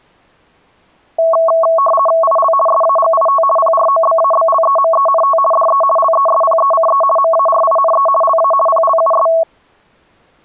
RTTY (50 baud, 450 Hz shift), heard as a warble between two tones, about 880 Hz centre. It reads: IL SAGIT PROBABLEMENT DE LESPECE MARINE LA PLUS